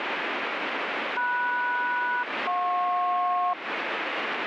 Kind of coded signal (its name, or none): aircraft SELCAL